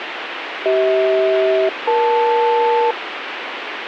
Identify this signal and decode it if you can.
Aircraft SELCAL, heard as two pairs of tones, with radio hiss. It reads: CH-EL